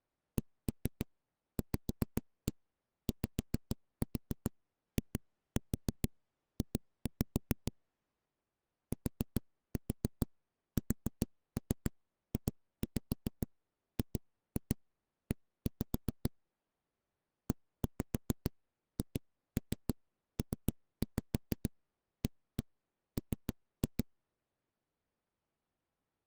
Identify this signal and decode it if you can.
Tap code, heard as knocks on a wall, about 7 knocks a second. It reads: CVYIJ TSJGE EHPAM